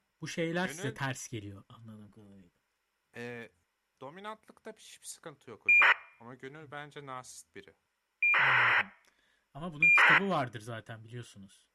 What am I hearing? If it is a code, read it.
ACARS aircraft data, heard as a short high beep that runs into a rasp, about 2400 baud, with speech in Turkish.